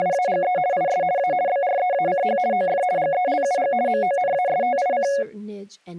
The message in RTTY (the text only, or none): … IS A BREACH OF GELUG MONASTIC